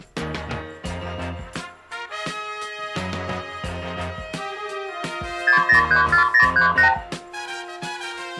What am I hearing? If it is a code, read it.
Multi-frequency trunk signalling (R2, with the far end's replies), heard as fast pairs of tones, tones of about 110 ms. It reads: 6034038